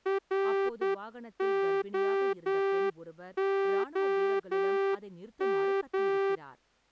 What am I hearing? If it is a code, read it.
Morse code, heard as a horn, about 10 wpm, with speech in Tamil. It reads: ROOM